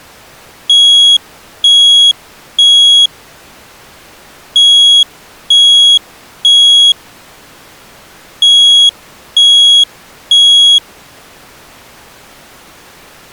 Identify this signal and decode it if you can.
Alarm pattern, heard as an alarm's beeps, played three times, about 3300 Hz. Temporal three. Smoke or fire, evacuate.